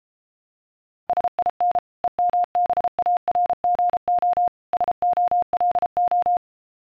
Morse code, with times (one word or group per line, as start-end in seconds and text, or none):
1.1-1.8 SIN
2.0-4.5 EMBARGO
4.7-6.4 SOLO